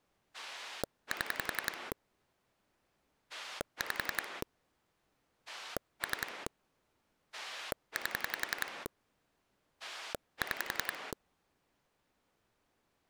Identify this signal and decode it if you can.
Pulse dialling, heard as a rotary dial, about 11 pulses a second. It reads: 7 5 3 8 6